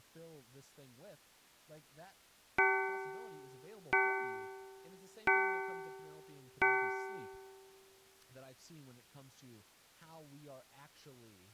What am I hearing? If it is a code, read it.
Clock strike, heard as a bell, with speech in English. 4. Four o'clock.